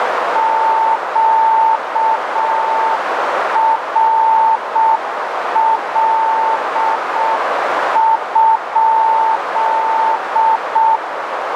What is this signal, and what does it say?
Morse code, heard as a keyed tone, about 6 wpm, 890 Hz, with heavy radio static and a narrow filter. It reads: QRL?